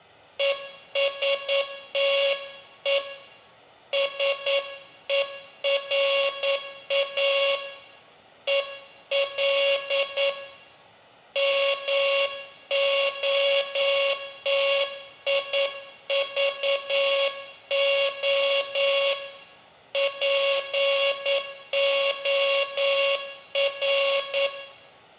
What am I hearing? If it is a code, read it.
Morse code, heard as a buzzer, hand-sent with a paddle, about 9 wpm, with room echo. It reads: ESTE SERA EL MOTIVO POR